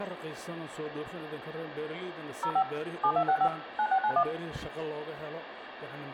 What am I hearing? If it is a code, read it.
DTMF, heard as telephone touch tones, dialled by machine, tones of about 70 ms, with phone line noise and room echo. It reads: 05 7265 9691